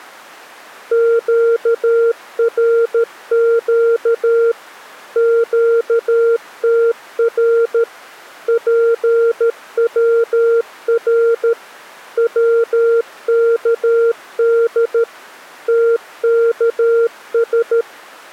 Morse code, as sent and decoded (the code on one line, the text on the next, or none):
--.- .-. --.- / --.- - .-. / .--. .-- .-. / .-- -.- -.. / - -.- ...
QRQ QTR PWR WKD TKS